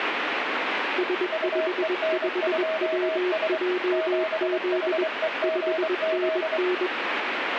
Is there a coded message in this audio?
Yes: Morse code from 0.9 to 6.9 s, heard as two keyed tones, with radio static. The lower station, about 21 wpm, 360 Hz: S55WJZ 5NN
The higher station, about 24 wpm, 640 Hz: UEN2S 7HEGZ